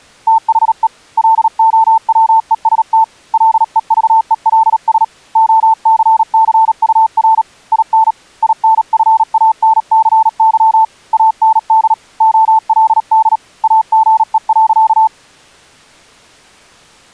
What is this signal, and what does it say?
Morse code, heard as a keyed tone, hand-sent with a paddle, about 37 wpm, 890 Hz. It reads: THE LOWEST LEVELS OCCUR IN INFANCY AND OLD AGE.